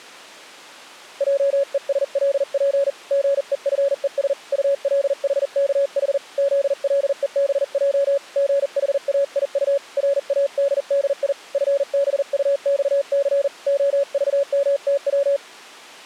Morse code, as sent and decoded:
.--- . ... .-.. .--. / --. . ..-. . ... / ..- .-.. .... -.- .... / --.. .-.. . -... .--- / --. .... .- .. ..- / .-. .- -.. -.. .. / ..-. -... ..- -..- -.-. / --- ...- -- - .--
JESLP GEFES ULHKH ZLEBJ GHAIU RADDI FBUXC OVMTW

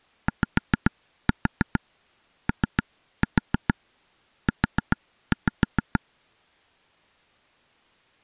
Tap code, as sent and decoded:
5-4 3-4 4-5
YOU

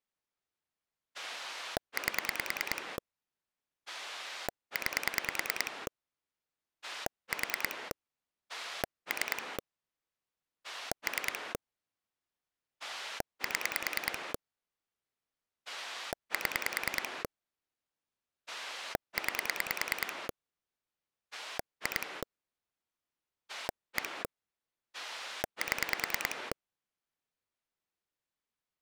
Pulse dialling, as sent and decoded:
8 / 9 / 4 / 3 / 3 / 7 / 7 / 9 / 2 / 1 / 7
8 9 4 3 3 7 7 9 2 1 7

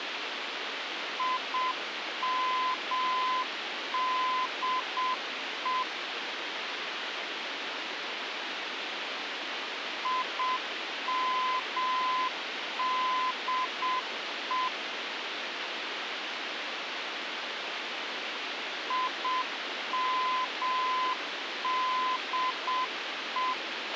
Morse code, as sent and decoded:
.. -- -.. . / .. -- -.. . / .. -- -.. .
IMDE IMDE IMDE

